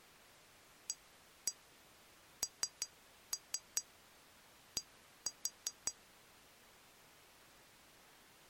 Tap code, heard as taps on glass, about 5 knocks a second. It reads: AND